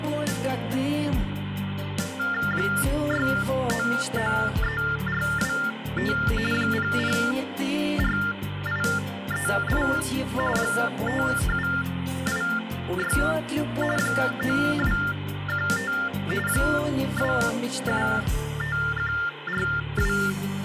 TTY/TDD text telephone tones (45.45 baud Baudot), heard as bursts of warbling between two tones, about 400 Hz shift, 1600 Hz centre, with phone line noise. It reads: 6993425 004838 5786 9215 275142